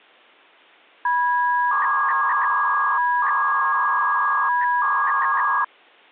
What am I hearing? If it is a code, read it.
300-baud modem data (V.21 tones), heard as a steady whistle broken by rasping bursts, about 300 baud, 200 Hz shift.